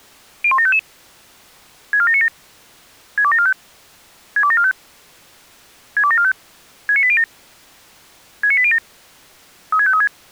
Five-tone selective call (ZVEI), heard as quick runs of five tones, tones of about 70 ms. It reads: 01755 64797 62745 62745 62745 69807 69807 36536